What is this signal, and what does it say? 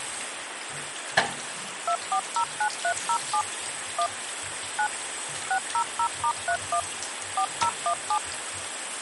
DTMF, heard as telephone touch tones, dialled by machine, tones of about 80 ms, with phone line noise and the noise of a restroom. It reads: 2409307 1 9 600*31 4017